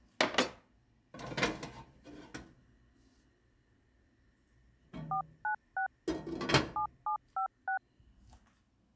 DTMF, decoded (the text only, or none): 496 7756